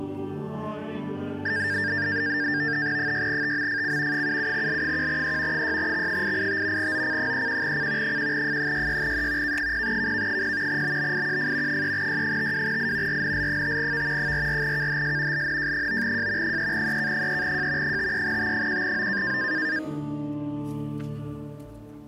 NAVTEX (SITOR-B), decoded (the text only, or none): 6TMFC 77L1E 6X885 OC31C 1F66E K0KK0 BBIQF 3Y52I RNL5V 44KHS LNJ9J 3EK3J 53T1O